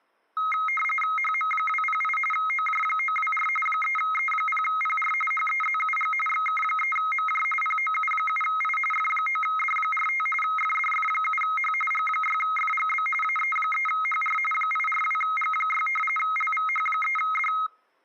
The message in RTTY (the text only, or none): HM208 OJ924 3E0PR HEZUG XK3MJ POU7I F9D45 FDF7H G6FGB AE3HR 842G6 LVH3D